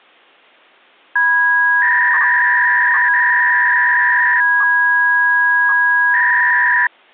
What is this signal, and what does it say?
300-baud modem data (V.21 tones), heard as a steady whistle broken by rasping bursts, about 300 baud, 200 Hz shift.